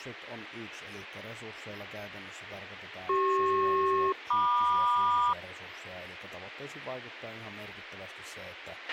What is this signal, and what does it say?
Aircraft SELCAL, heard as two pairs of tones, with a squelch burst at the end and speech in Finnish. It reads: CP-MQ